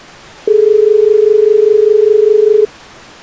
Telephone call progress tone (as in Australia), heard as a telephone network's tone, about 430 Hz. Dial tone.